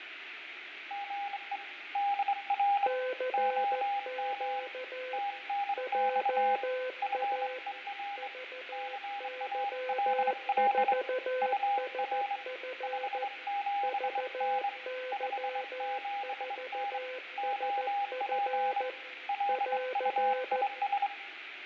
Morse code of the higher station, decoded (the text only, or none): GE DR OM TNX FER CALL UR 57N 57N OP LUIS